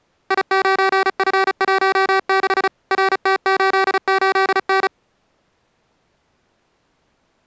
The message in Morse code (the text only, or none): I9F16 RT88N